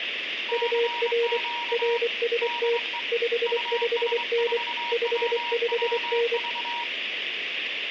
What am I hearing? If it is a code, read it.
Morse code, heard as two keyed tones, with radio static and room echo. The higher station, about 24 wpm, 950 Hz: CQ DE US4WWV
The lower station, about 24 wpm, 470 Hz: UR RST 55N 55N